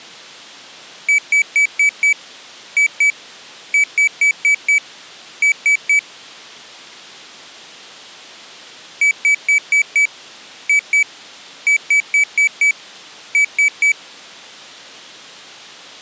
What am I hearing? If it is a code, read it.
Beep code, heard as a piezo beeper, played twice, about 2300 Hz. 5-2-5-3.